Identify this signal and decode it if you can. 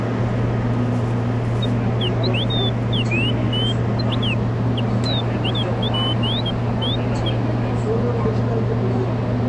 Bird-like chirps, with the noise inside a subway train. There is no code.